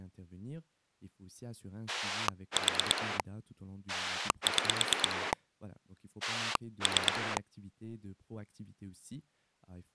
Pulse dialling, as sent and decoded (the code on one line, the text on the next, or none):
4 / 6 / 3
4 6 3